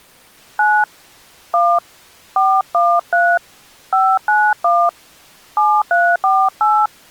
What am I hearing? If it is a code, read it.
DTMF, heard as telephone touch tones, dialled by hand, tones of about 250 ms. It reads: 9 1 413 591 7348